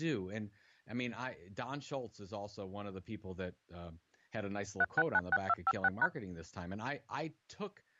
DTMF, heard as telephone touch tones, dialled by machine, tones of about 40 ms, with speech in English. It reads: 3696256#